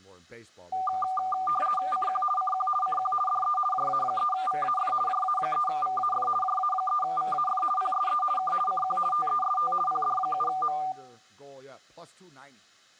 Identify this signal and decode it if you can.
RTTY (50 baud, 450 Hz shift), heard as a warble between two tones, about 980 Hz centre, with speech in English. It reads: CQ CQ CQ DE JA3VAF JA3VAF JA3VAF PSE K CQ TEST PD7M